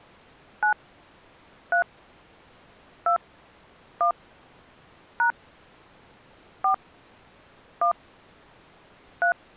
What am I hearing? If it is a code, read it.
DTMF, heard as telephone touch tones, dialled by hand, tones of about 100 ms. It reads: 9 3 2 1 # 4 1 3